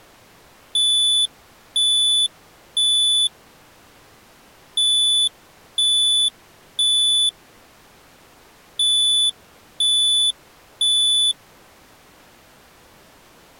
Alarm pattern, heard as an alarm's beeps, played three times, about 3500 Hz. Temporal three. Smoke or fire, evacuate.